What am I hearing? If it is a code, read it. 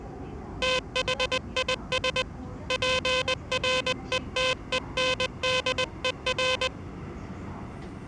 Morse code, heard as a buzzer, hand-sent with a paddle, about 20 wpm, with the noise inside a subway train. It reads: THIS PRETENDER